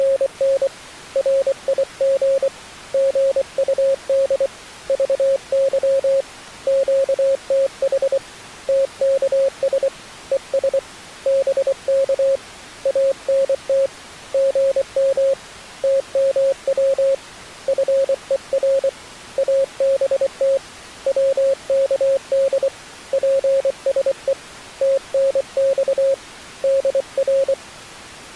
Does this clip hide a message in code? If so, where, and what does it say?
Yes: Morse code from 0.0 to 27.6 s, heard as a keyed tone, hand-sent with a paddle, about 24 wpm, 540 Hz. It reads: … RIG GUD VY QTH TKS ES BK ANT GM TMW FER ABT WKD PSE TNX DR